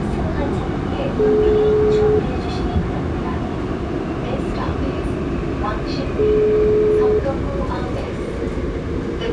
Telephone call progress tone (single-tone plan, as in most of Europe), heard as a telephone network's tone, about 420 Hz, 1 s on and 4 s off, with the noise inside a subway train. Ringback tone.